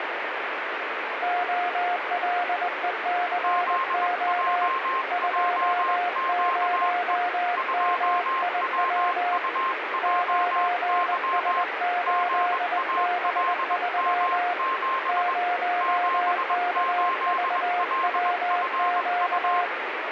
Morse code, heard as two keyed tones, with radio static. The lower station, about 20 wpm, 710 Hz: OLECO 20MIW 9S8B3 0KVWQ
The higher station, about 21 wpm, 1060 Hz: ZJJQE 2WUJY GALM7 78LFU